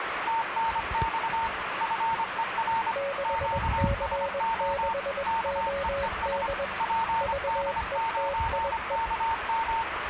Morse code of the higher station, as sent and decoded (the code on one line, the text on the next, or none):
- -. -..- / ..-. . .-. / --.- ... --- / -.- . . ... / .--. -.. ----. -.- --
TNX FER QSO KEES PD9KM